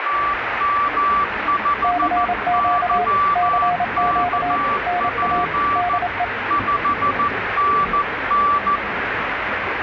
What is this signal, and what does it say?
Morse code, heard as two keyed tones, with radio static and the noise of a crowd indoors. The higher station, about 14 wpm, 1160 Hz: TM5YKP 5NN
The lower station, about 27 wpm, 710 Hz: CQ CQ NA DE